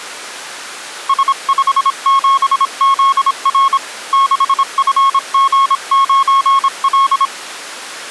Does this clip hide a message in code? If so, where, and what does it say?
Yes: Morse code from 1.0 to 7.3 s, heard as a keyed tone, hand-sent with a paddle, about 26 wpm, 1090 Hz. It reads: S57ZR 6FG9L